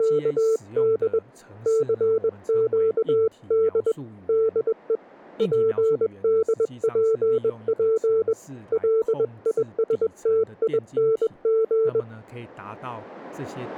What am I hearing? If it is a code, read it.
Morse code, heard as a keyed tone, hand-sent with a bug key, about 21 wpm, 440 Hz, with speech in Chinese. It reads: … CQD DE PDPP LISTING